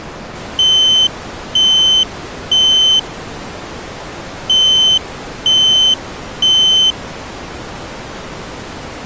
Alarm pattern, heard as an alarm's beeps, played twice, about 3050 Hz. Temporal three. Smoke or fire, evacuate.